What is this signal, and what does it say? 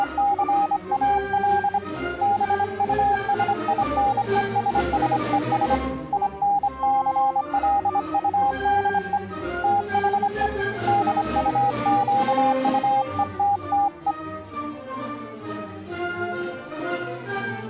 Morse code, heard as a keyed tone, hand-sent with a straight key, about 25 wpm, 810 Hz. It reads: … BUSINESSES INCLUDE THE DUQUETTE